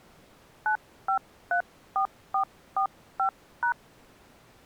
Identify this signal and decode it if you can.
DTMF, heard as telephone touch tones, dialled by hand, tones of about 90 ms. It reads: 9534445#